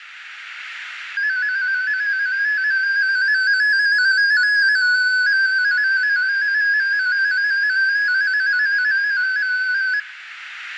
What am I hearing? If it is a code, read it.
Multi-tone FSK (Olivia or MFSK type), about 250 Hz wide, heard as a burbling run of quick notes, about 15.625 baud, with radio static and room echo.